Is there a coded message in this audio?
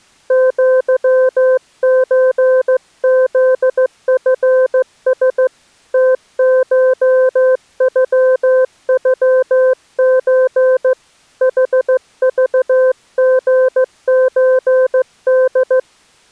Yes: Morse code (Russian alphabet) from 0.2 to 15.9 s, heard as a keyed tone, hand-sent with a straight key, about 15 wpm, 520 Hz. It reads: ЪЧЗФС ТШЮЮЧ ХЖГЧД